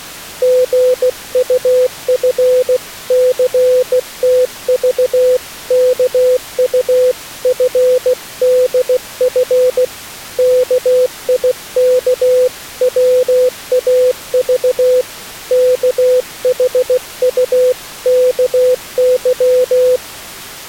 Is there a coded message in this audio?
Yes: Morse code (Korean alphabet) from 0.4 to 20.0 s, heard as a keyed tone, hand-sent with a bug key, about 16 wpm, 500 Hz. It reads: 신철이는 양볼 위에